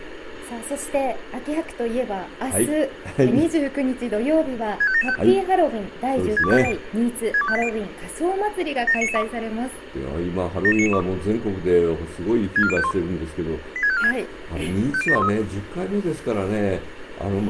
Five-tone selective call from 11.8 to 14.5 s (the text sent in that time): 64051 86546